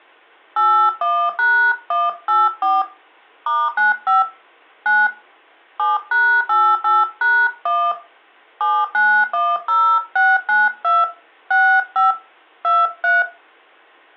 DTMF, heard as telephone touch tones, dialled by hand, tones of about 240 ms. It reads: 81#184 *95 9 7#88#1 7910692 65 23